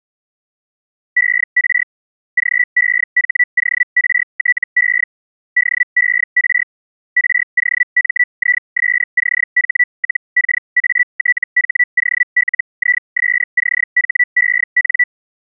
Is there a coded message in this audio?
Yes: Hellschreiber (Feld-Hell, 122.5 baud) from 1.2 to 15.0 s, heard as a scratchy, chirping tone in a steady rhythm, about 1950 Hz. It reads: ER GEHORTE DER ROMISCH-KATHOLISCHEN